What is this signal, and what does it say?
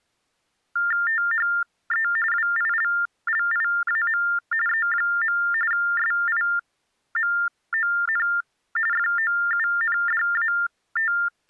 TTY/TDD text telephone tones (45.45 baud Baudot), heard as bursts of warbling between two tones, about 400 Hz shift, 1600 Hz centre. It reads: THE WILLIAM E. SIMON …